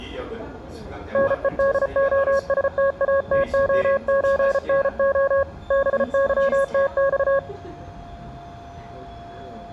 Morse code (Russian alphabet), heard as a keyed tone, hand-sent with a paddle, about 34 wpm, 550 Hz, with the noise inside a subway train. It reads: НЕДОСТАТОЧНО БЫТЬ